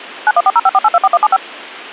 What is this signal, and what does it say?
DTMF, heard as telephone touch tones, dialled by machine, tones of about 40 ms. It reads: 914054824175